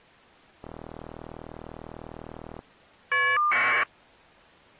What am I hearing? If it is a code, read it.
Caller ID data burst, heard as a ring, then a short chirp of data, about 1200 baud.